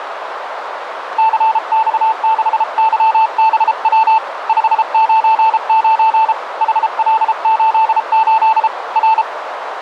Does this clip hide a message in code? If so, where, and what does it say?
Yes: Morse code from 1.1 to 9.3 s, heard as a keyed tone, hand-sent with a paddle, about 33 wpm, 880 Hz, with radio static and a narrow filter. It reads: CX6YBW 599 HL88 R